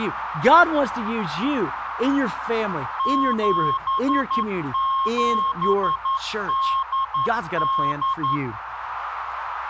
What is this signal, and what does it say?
Morse code (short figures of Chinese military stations), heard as a keyed tone, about 11 wpm, 1080 Hz, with radio static, a narrow filter and speech in English. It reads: 7788